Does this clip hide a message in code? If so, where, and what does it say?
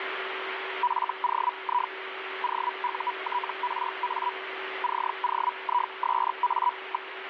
Yes: Hellschreiber (Feld-Hell, 122.5 baud) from 0.8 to 7.1 s, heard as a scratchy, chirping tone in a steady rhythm, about 980 Hz, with radio static and a steady whistle near 380 Hz. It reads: FOI OUTRA COISA.